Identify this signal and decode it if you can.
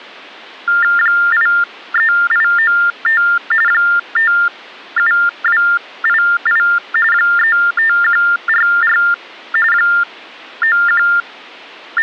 TTY/TDD text telephone tones (45.45 baud Baudot), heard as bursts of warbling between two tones, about 400 Hz shift, 1600 Hz centre. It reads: 83895 57288 35144 …